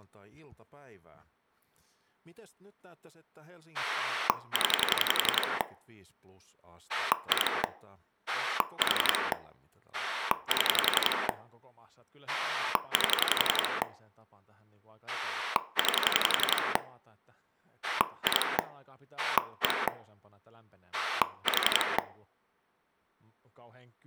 Pulse dialling, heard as a rotary dial, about 11 pulses a second, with room echo and speech in Finnish. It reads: 0 2 4 7 8 9 2 1 4